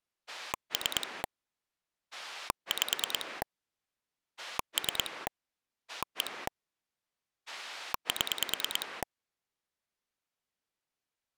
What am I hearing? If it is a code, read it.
Pulse dialling, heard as a rotary dial, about 9 pulses a second. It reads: 3 5 3 1 7